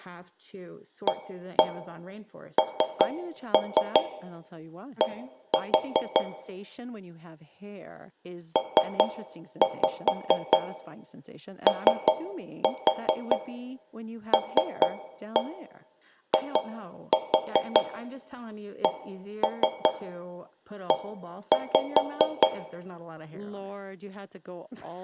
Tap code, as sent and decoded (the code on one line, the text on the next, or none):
1-1 3-3 1-4 / 3-5 3-4 3-1 2-4 1-3 1-5
AND POLICE